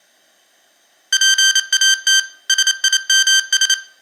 Morse code, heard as electronic beeps, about 28 wpm, 1550 Hz, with room echo. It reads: PAT SIMS